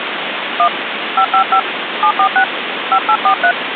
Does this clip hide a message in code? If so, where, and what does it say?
Yes: DTMF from 0.6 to 3.5 s, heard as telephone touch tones, dialled by hand, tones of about 80 ms, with phone line noise. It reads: 1 555 746 5843